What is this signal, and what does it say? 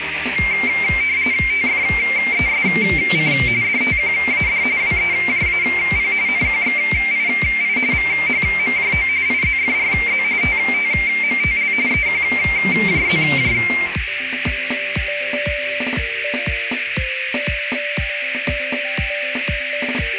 RTTY (45.45 baud, 170 Hz shift), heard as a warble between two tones, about 2200 Hz centre, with radio static and a narrow filter. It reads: TFESC DTQAD WEJAP NQXII VHMJO IZFRZ TTMTL EQJZJ